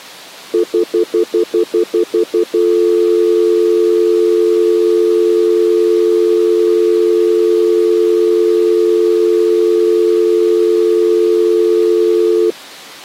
Telephone call progress tone (North American plan), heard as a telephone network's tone, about 350, 440 Hz, 0.1 s on and 0.1 s off. Stutter dial tone.